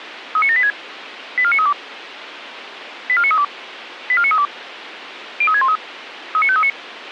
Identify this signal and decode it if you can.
Five-tone selective call (ZVEI), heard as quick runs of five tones, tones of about 70 ms, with radio hiss. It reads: 39786 84932 84932 84932 03613 39539